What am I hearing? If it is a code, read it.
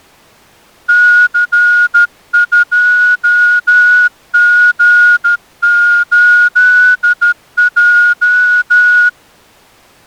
Morse code, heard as a whistle, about 13 wpm. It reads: C2G8J